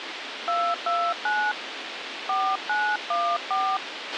DTMF, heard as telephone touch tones, dialled by hand, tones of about 260 ms, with radio hiss and a squelch burst at the end. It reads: 229 4914